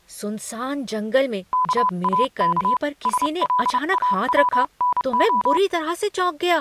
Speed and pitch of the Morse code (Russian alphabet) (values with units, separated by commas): 29 wpm, 1000 Hz